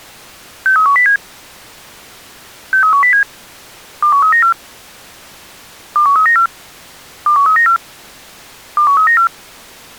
Five-tone selective call (CCIR), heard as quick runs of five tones, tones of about 100 ms. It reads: 63107 63107 21394 21394 21394 21394